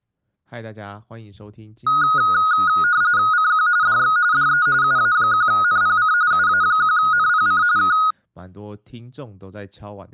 RTTY (45.45 baud, 170 Hz shift), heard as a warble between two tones, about 1350 Hz centre, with speech in Chinese. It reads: CQ DX DE UA1NPC UA1NPC K